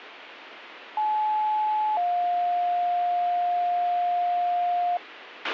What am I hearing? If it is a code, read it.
Two-tone page, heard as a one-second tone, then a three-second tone, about 860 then 710 Hz, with radio hiss and a squelch burst at the end.